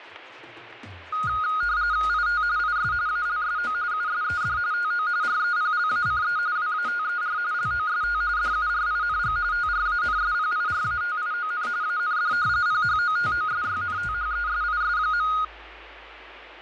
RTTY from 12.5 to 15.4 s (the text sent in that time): PHOTOSYNTHESIS.